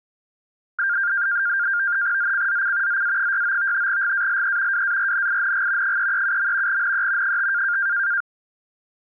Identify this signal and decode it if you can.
NAVTEX (SITOR-B), 100 baud, 170 Hz shift, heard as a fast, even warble, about 1500 Hz centre. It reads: ZCZC ZA69 GALE WARNING 337. NE 5